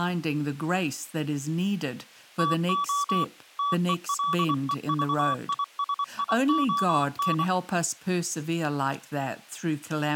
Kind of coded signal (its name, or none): Morse code